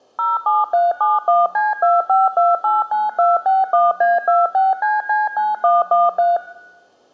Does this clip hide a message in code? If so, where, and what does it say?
Yes: DTMF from 0.2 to 6.4 s, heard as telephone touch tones, dialled by machine, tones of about 180 ms. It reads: 07371C25289261A26CC9113